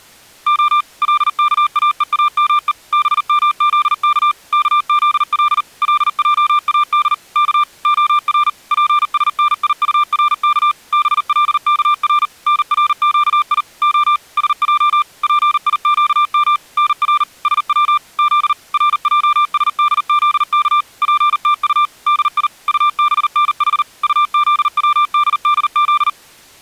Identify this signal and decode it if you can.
Morse code (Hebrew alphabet), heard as a keyed tone, machine-sent, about 39 wpm, 1190 Hz. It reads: ה לכאואמו במזך כזל לעאד כ הר פשניטרך בלכר נרקי ה שע פיקם נר שץ ז רעשדזך פתט די טבנח טזצדדז